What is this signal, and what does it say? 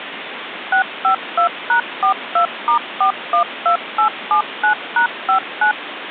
DTMF, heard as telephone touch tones, dialled by machine, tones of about 100 ms, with phone line noise. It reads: 652#42*412879#59